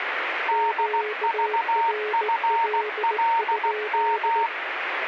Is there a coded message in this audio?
Yes: Morse code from 0.4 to 4.5 s, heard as two keyed tones, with radio static. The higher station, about 16 wpm, 920 Hz: DVFLM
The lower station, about 18 wpm, 420 Hz: QRL?